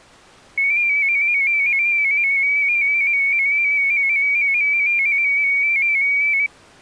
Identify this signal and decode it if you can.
Multi-tone FSK (Olivia or MFSK type), about 250 Hz wide, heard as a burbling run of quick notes, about 15.625 baud.